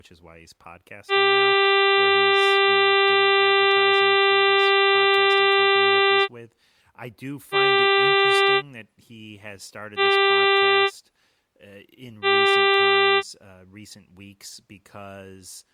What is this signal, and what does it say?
Ship horn signal, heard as a ship's horn, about 390 Hz, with speech in English. 1 long, 3 short. At sea: a vessel under tow in fog.